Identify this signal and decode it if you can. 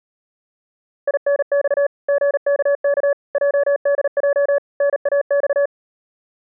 Morse code, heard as a keyed tone, machine-sent, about 38 wpm, 570 Hz. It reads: INX GKK JDJ NAX